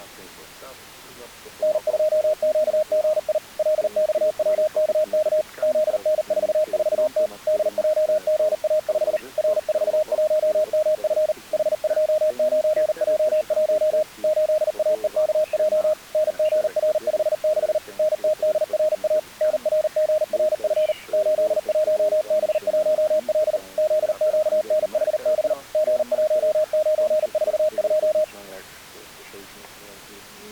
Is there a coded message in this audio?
Yes: Morse code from 1.6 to 28.3 s, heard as a keyed tone, machine-sent, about 39 wpm, 620 Hz. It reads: N2QGI LXWKK ZN44T DJGA5 R41MF H29J1 8AEKJ NGR56 NTDRA NRGRF 81B1L ZQNHB G1942